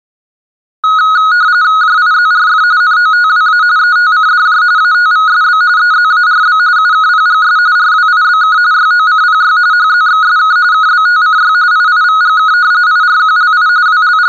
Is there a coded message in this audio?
Yes: RTTY (45.45 baud, 170 Hz shift) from 0.8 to 14.3 s, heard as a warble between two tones, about 1360 Hz centre. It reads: JIZRF NOTWA ETCDJ ATVSB EZARB UKPGS RWIBK YOCPY HZXSK KBTCY IIVGK IRQLI …